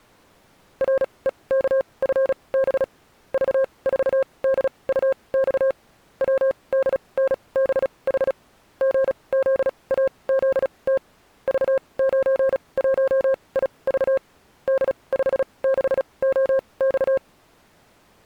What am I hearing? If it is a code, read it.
Morse code, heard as a keyed tone, machine-sent, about 36 wpm, spaced as for 25 wpm, 530 Hz. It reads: REKFB V4DUX WDNBH GZAZT V91IV D56OX